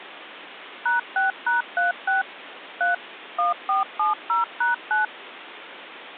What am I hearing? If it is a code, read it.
DTMF, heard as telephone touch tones, dialled by machine, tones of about 140 ms, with phone line noise. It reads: #6#36 3 1470#9